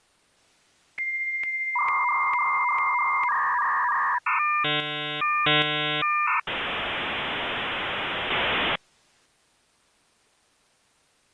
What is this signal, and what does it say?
Dial-up modem handshake (V.34 or later), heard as a whistle, warbles, then hiss.